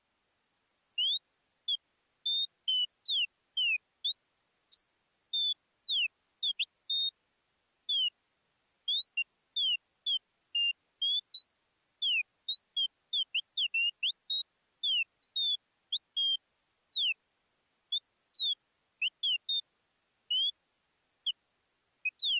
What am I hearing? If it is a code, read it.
Bird-like chirps. There is no code.